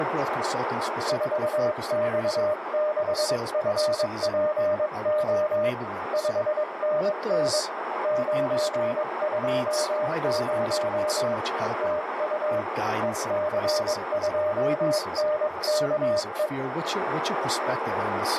Morse code, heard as a keyed tone, hand-sent with a paddle, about 22 wpm, 610 Hz, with heavy radio static, a narrow filter and speech in English. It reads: 4X6FPO 5NN 920 TU EC2NKE